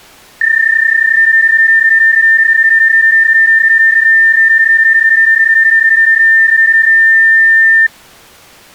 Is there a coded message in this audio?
Yes: PSK31 (31.25 baud) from 0.4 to 7.9 s, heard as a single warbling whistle, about 1800 Hz.